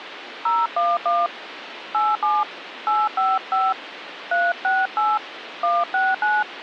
DTMF, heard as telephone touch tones, dialled by hand, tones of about 210 ms, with phone line noise. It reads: 011 87 855 368 169